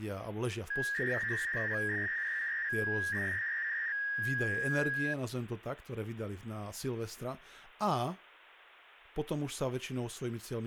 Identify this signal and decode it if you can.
300-baud modem data (V.21 tones), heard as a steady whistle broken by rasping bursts, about 300 baud, 200 Hz shift, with phone line noise and speech in Slovak.